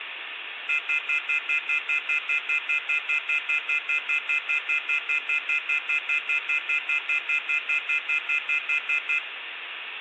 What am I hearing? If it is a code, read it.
Telephone call progress tone (North American plan), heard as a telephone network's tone, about 1400, 2050, 2450, 2600 Hz, 0.1 s on and 0.1 s off, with phone line noise and room echo. Off-hook warning tone.